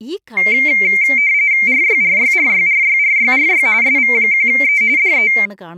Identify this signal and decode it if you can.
RTTY (45.45 baud, 170 Hz shift), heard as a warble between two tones, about 2200 Hz centre, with speech in Malayalam. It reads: RYRYRYRYRYRY SV1E DE